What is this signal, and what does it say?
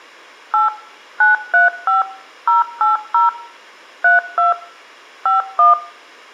DTMF, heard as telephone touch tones, dialled by machine, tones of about 150 ms. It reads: 8 935 080 32 51